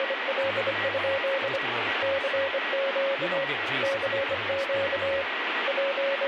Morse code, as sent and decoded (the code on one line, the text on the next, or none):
… / -.-. --.- / -.-. --.- / …
… CQ CQ …